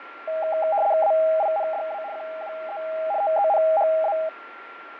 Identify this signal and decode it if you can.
RTTY (75 baud, 170 Hz shift), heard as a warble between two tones, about 720 Hz centre, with radio static, fading and a steady whistle near 1380 Hz. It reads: AINDA QUE TENHA